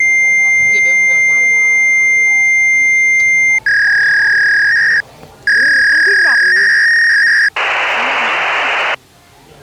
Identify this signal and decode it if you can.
Fax machine handshake, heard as a long tone, a warble and hiss, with the noise of a restaurant.